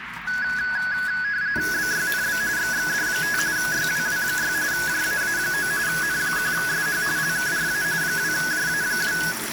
RTTY (45.45 baud, 170 Hz shift), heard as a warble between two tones, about 1600 Hz centre, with radio static, a narrow filter and the noise of a restroom. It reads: BYNB XXD5 YWW6 JAA9 N1SH LKRA 2JA2